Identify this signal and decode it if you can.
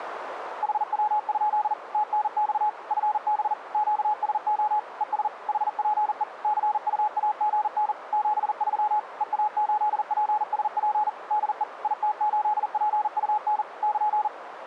Morse code, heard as a keyed tone, machine-sent, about 40 wpm, 850 Hz, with radio static and a narrow filter. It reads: HW? TNX FB QSO ES HPE CUAGN 73 EA8PSP DE IT8PUN <KN>